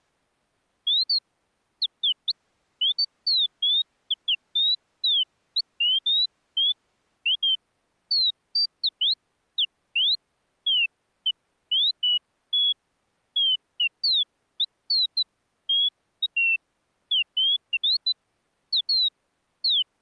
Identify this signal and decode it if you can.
Bird-like chirps. There is no code.